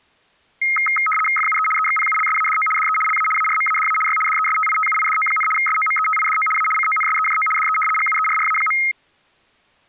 RTTY (75 baud, 850 Hz shift), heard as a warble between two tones, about 1700 Hz centre. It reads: FUE EXPULSADO DE LA ARMADA Y DESTITUIDO, SOMETIDO A CONSEJO DE GUERRA.